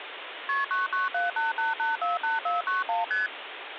Multi-frequency trunk signalling (R1, as on North American trunks), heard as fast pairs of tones, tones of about 160 ms, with phone line noise. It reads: KP 99788848491 ST